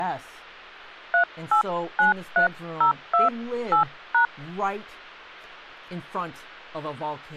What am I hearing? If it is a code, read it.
DTMF, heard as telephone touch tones, dialled by hand, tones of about 110 ms, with hum and speech in English. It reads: 3893028#